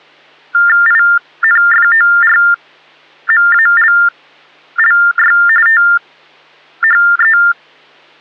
TTY/TDD text telephone tones (45.45 baud Baudot), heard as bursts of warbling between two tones, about 400 Hz shift, 1600 Hz centre. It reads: INFORMALLY THE